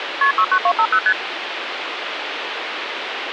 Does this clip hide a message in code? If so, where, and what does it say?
Yes: multi-frequency trunk signalling (R1, as on North American trunks) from 0.2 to 1.1 s, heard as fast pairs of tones, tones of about 70 ms, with phone line noise. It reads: KP 69250 ST